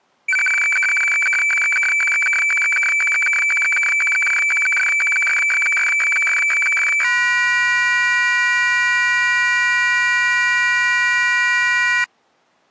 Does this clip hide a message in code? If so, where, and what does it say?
Yes: weather fax (radiofax), 120 lines a minute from 0.3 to 12.0 s, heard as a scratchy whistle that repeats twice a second.